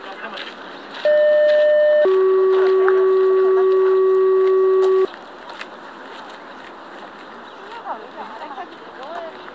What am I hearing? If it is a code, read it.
Two-tone page, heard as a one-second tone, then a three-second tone, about 600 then 380 Hz, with the noise of a park.